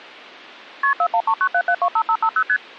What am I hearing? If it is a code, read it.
Multi-frequency trunk signalling (R1, as on North American trunks), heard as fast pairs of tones, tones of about 70 ms. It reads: KP 41397725550 ST